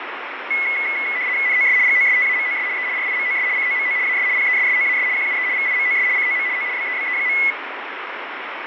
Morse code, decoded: none

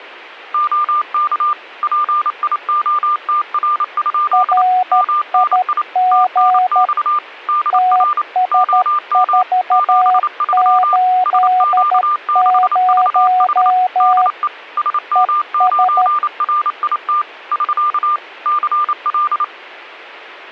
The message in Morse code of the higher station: OK PIOTR? MNI TNX DR OM 73 SQ6VH DE SM9RIT <SK> CL

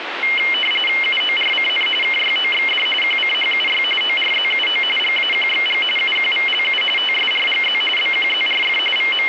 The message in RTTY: UORCN KYOXD QCHUY ORZUO GAQXG UQVLU TSRGZ BQZRF …

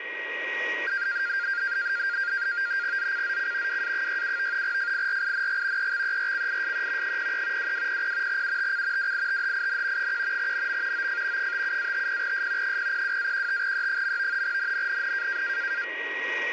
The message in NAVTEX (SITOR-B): ZCZC WA67 FIRING EXERCISE 03 2200 UTC WITHIN 1 NM OF 57-50S 002-15E. NNNN

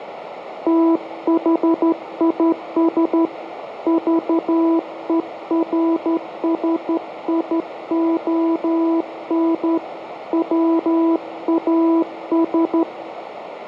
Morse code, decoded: THIS VERSION WAS

